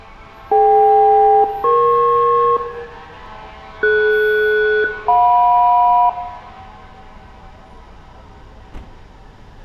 Aircraft SELCAL, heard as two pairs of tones, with room echo and street noise. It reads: DK-EP DS-JM